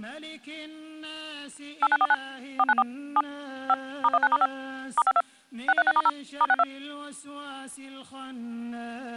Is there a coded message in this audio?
Yes: DTMF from 1.8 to 6.6 s, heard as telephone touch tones, dialled by machine, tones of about 40 ms. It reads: 8949 494 7 5 *19*5 *52 636*0 *62